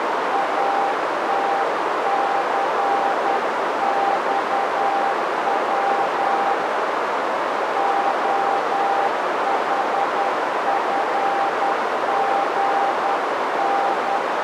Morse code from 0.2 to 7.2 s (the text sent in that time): ATCXW